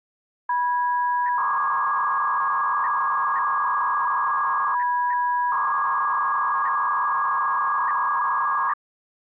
300-baud modem data (V.21 tones), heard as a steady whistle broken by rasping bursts, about 300 baud, 200 Hz shift.